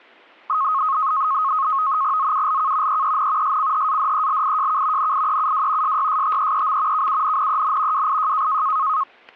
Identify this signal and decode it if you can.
NAVTEX (SITOR-B), 100 baud, 170 Hz shift, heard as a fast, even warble, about 1170 Hz centre, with static crashes. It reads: ZULK EEN SCHADELIJK NIEUW SYSTEEM KUNNEN WIJ